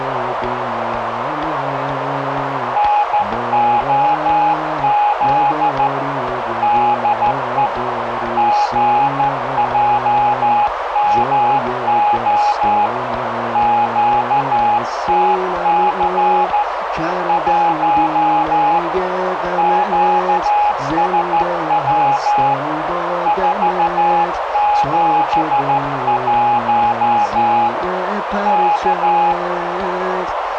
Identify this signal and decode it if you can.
Morse code, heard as a keyed tone, hand-sent with a straight key, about 13 wpm, 830 Hz, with radio static and a narrow filter. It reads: NOZ DE GJMO QTC 1 QSW 471 K